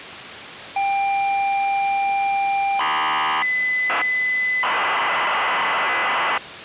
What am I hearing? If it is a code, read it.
ZX Spectrum tape loading, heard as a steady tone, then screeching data.